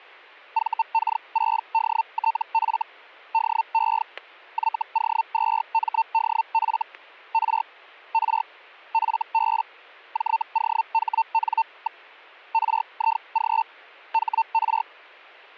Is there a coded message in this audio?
Yes: Hellschreiber (Feld-Hell, 122.5 baud) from 0.5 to 14.8 s, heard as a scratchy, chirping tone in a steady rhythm, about 900 Hz, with static crashes. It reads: VK6DTF DE YO2MDF R R FB JOHN. RIG HR